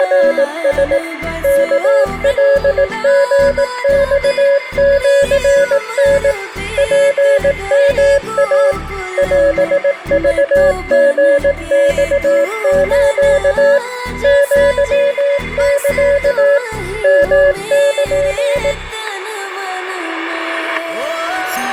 Morse code (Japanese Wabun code), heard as a keyed tone, machine-sent, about 18 wpm, 560 Hz, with static crashes and a weaker station near 2080 Hz. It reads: … ワカリマシタ ツヨイ オクリマス アサ ヨル